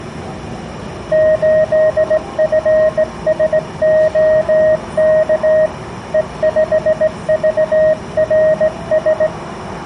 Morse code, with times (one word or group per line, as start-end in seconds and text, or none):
1.1-5.7 8FSOK
6.1-9.3 E5VRS